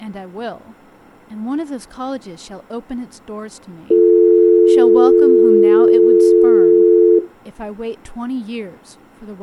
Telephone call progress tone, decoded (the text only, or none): dial tone